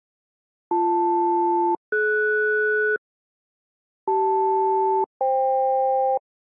Aircraft SELCAL, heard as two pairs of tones. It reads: BL-DS CL-FK